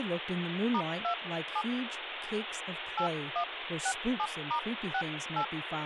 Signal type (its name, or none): DTMF